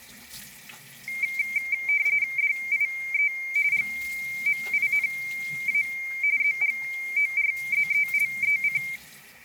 RTTY (45.45 baud, 170 Hz shift), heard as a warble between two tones, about 2200 Hz centre, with static crashes and the noise of a restroom. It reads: DIE GMINA ZGORZELEC